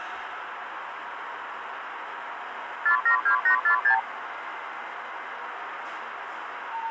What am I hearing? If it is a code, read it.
Multi-frequency trunk signalling (R2, with the far end's replies), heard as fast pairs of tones, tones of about 100 ms, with the noise inside a lift. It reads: 472846